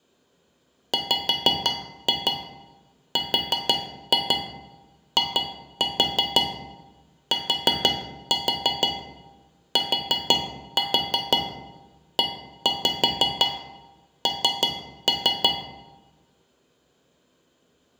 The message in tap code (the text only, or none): WRITTEN